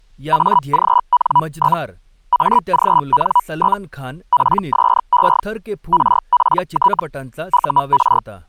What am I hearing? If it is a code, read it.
Hellschreiber (Feld-Hell, 122.5 baud), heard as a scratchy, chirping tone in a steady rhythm, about 980 Hz, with speech in Marathi. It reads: AGN? AGN? PSE RPT UR